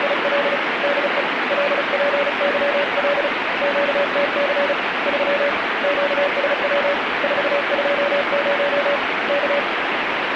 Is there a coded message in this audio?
Yes: Morse code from 0.0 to 9.7 s, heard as a keyed tone, hand-sent with a paddle, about 35 wpm, 570 Hz, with heavy radio static. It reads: … DE LPYL QTC 3 QSW 420 K